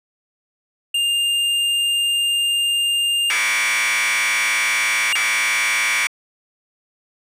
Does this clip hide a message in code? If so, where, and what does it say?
Yes: Commodore tape loading (standard loader) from 0.9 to 6.1 s, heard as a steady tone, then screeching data.